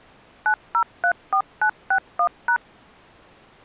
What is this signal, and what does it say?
DTMF, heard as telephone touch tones, dialled by machine, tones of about 80 ms. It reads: 9034961#